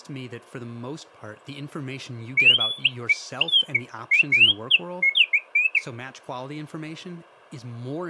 Bird-like chirps, with speech in English. There is no code.